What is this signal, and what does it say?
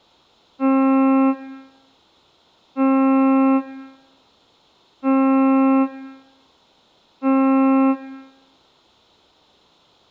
Ship horn signal, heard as a ship's horn, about 270 Hz, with room echo. 4 short. At sea: a pilot vessel's identity signal in fog.